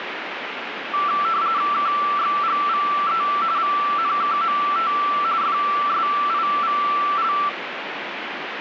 RTTY (45.45 baud, 170 Hz shift), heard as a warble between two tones, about 1250 Hz centre, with radio static. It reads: KXGVE VNKMT FSIVL